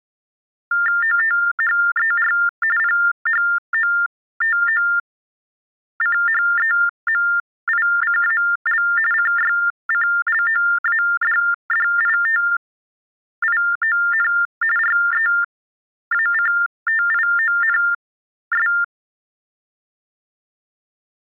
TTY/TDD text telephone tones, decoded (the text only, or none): OTHER PHOTOCHEMICAL CYCLOADDITION REACTIONS